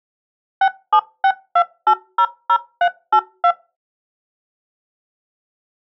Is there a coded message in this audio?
Yes: DTMF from 0.6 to 3.5 s, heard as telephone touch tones, dialled by machine, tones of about 70 ms. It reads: 6762800382